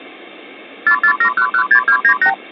Multi-frequency trunk signalling (R2, with the far end's replies), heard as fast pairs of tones, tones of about 80 ms. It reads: 447116298